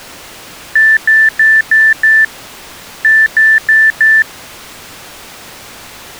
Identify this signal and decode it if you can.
Beep code, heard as beeps, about 1750 Hz. 5-4.